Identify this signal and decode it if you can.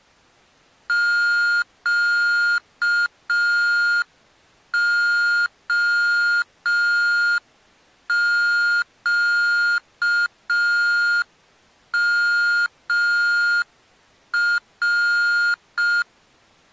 Morse code, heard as electronic beeps, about 5 wpm, 1420 Hz. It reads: QOQMR